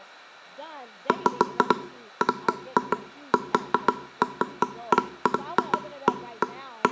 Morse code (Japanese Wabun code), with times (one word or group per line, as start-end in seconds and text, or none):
none